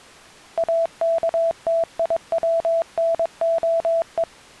Morse code (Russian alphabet), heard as a keyed tone, machine-sent, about 22 wpm, 660 Hz. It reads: АКТИВНОЕ